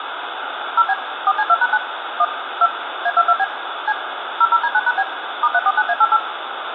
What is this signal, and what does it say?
DTMF, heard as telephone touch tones, dialled by machine, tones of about 50 ms, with phone line noise and room echo. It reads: 0B 4C2#9 1 2 A22B C 00D9#B *349A88